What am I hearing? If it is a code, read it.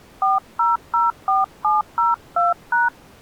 DTMF, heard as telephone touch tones, dialled by hand, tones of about 170 ms. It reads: 4004702#